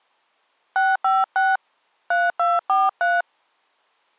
DTMF, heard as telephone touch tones, dialled by hand, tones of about 200 ms. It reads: 656 3243